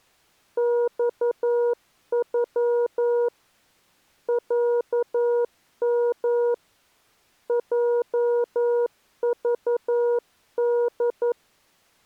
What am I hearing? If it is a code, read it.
Morse code (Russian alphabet), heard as a keyed tone, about 11 wpm, 480 Hz. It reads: ЬЮ ЯМ ЙЖД